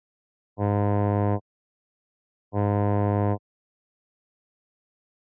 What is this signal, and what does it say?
Ship horn signal, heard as a ship's horn, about 100 Hz. 2 short. At sea: I am altering course to port.